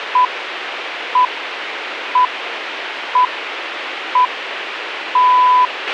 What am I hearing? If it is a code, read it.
Radio time signal (six pips, as the Greenwich Time Signal), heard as pips, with radio hiss and a squelch burst at the end.